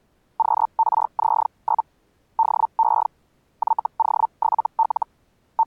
Hellschreiber (Feld-Hell, 122.5 baud), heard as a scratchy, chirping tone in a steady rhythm, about 900 Hz. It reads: QRZ? DE YO7L …